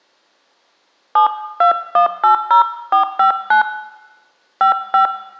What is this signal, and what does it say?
DTMF, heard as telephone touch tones, dialled by hand, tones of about 110 ms, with room echo. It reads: 72180459 55